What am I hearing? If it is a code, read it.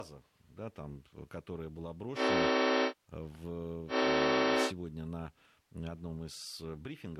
Train horn signal, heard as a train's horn, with speech in Russian. 2 short. On North American railways: a signal is acknowledged.